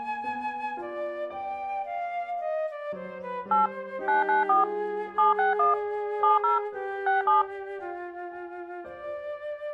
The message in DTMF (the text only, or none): 8 994 761 70 67